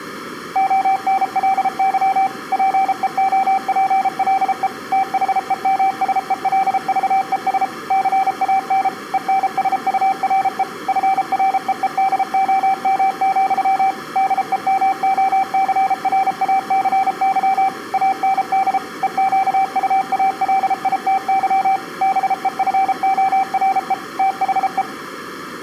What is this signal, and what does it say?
Morse code, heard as a keyed tone, machine-sent, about 33 wpm, 770 Hz. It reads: ONLY PEOPLE THEMSELVES CAN ENSURE FREEDOM, DEMOCRACY AND EQUALITY BEFORE THE